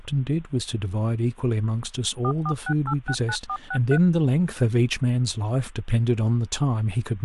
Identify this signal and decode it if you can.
DTMF, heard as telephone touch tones, dialled by machine, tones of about 70 ms, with speech in English. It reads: 446869463